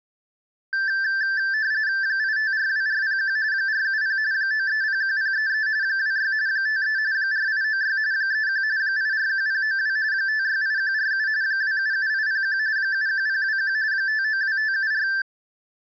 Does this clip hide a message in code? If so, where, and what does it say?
Yes: RTTY (45.45 baud, 170 Hz shift) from 0.7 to 15.2 s, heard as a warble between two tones, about 1650 Hz centre. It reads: 8542401 470 9301033 26 53 4896 31 841092 568147 277801 71021 592574